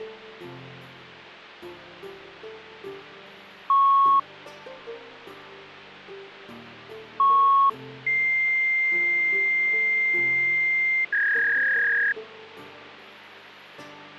Fax machine handshake, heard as beeps, a long tone and a warble, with phone line noise.